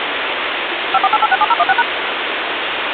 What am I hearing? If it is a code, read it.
DTMF, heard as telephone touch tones, dialled by machine, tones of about 40 ms, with phone line noise. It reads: 548867016#